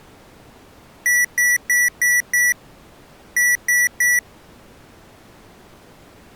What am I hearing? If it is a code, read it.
Beep code, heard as beeps from a small speaker, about 1950 Hz. 5-3.